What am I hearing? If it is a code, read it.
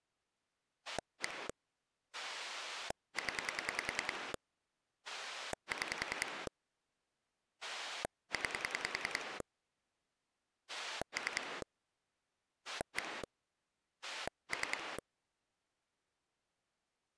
Pulse dialling, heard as a rotary dial, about 10 pulses a second. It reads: 1 0 6 9 3 1 3